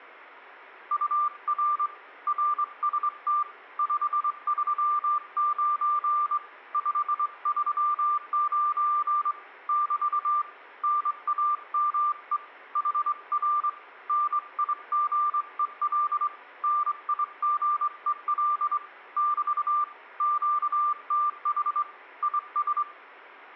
Morse code, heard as a keyed tone, hand-sent with a straight key, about 23 wpm, 1190 Hz, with room echo. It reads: UR RST 539 539 <BT> NAME HR NIGEL NIGEL <BT> QTH IS